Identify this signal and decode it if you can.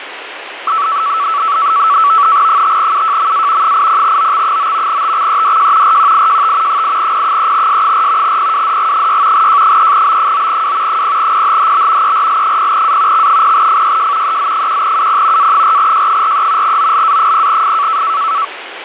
NAVTEX (SITOR-B), 100 baud, 170 Hz shift, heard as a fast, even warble, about 1230 Hz centre, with radio static. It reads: 5UJMA 80OX9 TXEDJ RQIJT 8P3S4 PWDG6 J3B9W 0PHHB ERL0A X0FYJ EZ1UP A4J43 OLA0F